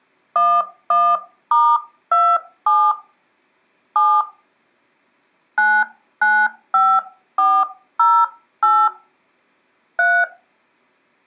DTMF, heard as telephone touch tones, dialled by hand, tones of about 250 ms. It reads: 11*27 7 995408 3